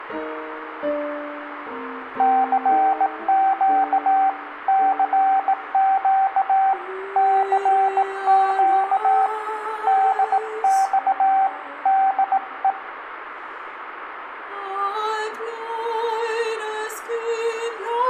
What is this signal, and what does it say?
Morse code, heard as a keyed tone, hand-sent with a bug key, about 18 wpm, 770 Hz, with room echo. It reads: CQ CQ CQ DX DE